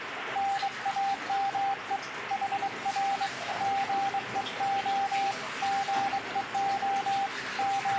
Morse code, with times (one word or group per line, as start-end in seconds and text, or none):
0.4-2.0 NAME
2.3-3.3 HR
3.6-5.3 GEO
5.6-7.3 GEO
7.6-8.0 …